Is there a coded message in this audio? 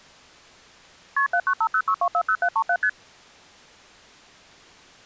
Yes: multi-frequency trunk signalling (R1, as on North American trunks) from 1.2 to 2.9 s, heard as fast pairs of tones, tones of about 70 ms. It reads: KP 79506240737 ST